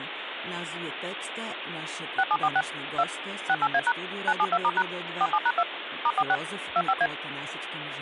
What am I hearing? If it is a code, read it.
DTMF, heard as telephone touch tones, dialled by machine, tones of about 50 ms, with phone line noise. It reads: 6746 2 68A# 972*# 47#2 *46 25A